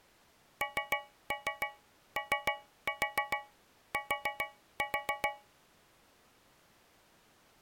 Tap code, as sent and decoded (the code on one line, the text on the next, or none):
3-3 3-4 4-4
NOT